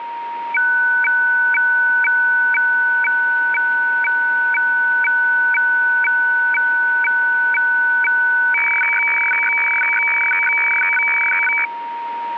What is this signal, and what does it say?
Weather fax (radiofax), 120 lines a minute, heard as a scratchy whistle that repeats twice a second, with radio static and a steady whistle near 940 Hz.